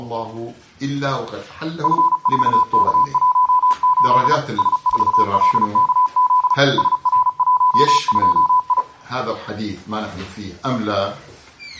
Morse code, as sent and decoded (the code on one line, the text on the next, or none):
..-. ....- -.- .---- ---.. / ... ....- .-.. -.- --.. / ... .-. .---- ..--- ..
F4K18 S4LKZ SR12I